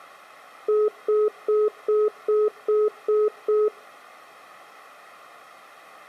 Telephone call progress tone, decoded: congestion tone

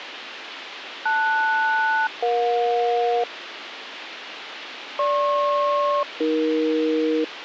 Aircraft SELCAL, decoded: LS-EJ GP-AE

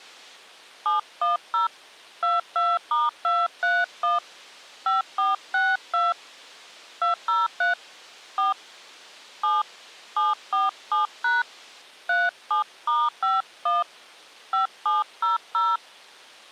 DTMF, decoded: 710 22*231 5462 203 4 7 747# 37*51 5700

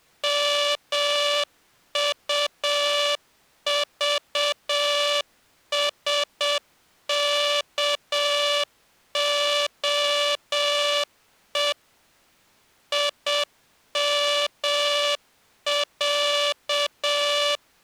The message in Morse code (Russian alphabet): МУЖСКОЕ ИМЯ

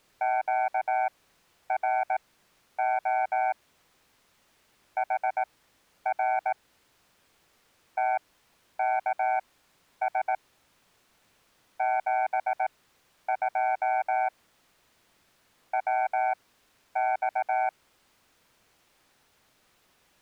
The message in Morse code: QRO HR TKS 72 WX

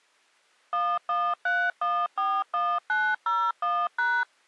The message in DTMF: 113141901#

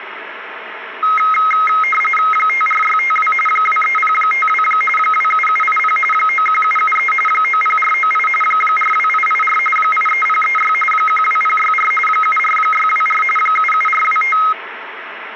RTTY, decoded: 54652 23052 27780 91773 90498 42884 83036 12064 74624 77425

